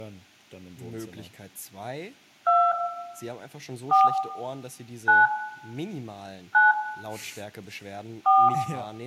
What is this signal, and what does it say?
DTMF, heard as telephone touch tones, dialled by hand, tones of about 220 ms, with room echo and speech in German. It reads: 2 4 9 9 4